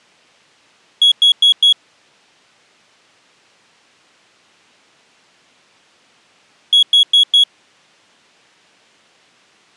Alarm pattern, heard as an alarm's beeps, played twice, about 3350 Hz. Temporal four. Carbon monoxide.